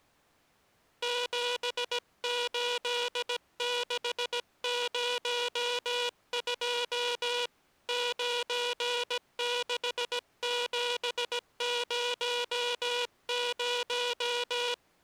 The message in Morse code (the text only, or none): 78602 96700